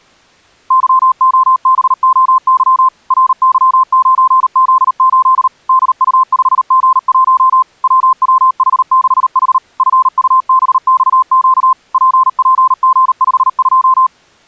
Morse code, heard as a keyed tone, machine-sent, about 38 wpm, 1040 Hz. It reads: YOBOY RY9Z8 DU5G1 WWH6H FUBXQ PPG52